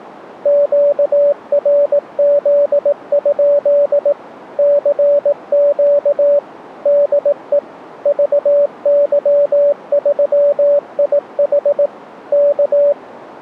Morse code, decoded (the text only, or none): QRZ? CQ DE VY3IH K